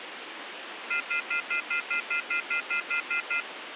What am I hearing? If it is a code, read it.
Telephone call progress tone (North American plan), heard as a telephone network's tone, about 1400, 2050, 2450, 2600 Hz, 0.1 s on and 0.1 s off, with phone line noise. Off-hook warning tone.